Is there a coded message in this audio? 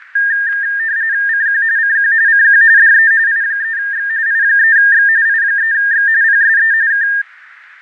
Yes: RTTY (45.45 baud, 170 Hz shift) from 0.2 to 7.2 s, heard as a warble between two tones, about 1700 Hz centre, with radio static, fading and static crashes. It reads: CQ CQ CQ DE I3X I3X I3X PSE K